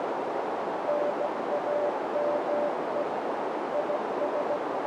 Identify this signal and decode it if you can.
Morse code, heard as a keyed tone, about 16 wpm, 590 Hz, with heavy radio static and a narrow filter. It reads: NAME IS